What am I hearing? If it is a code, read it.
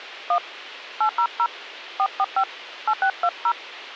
DTMF, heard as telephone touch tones, dialled by hand, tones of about 70 ms. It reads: 1 800 445 8620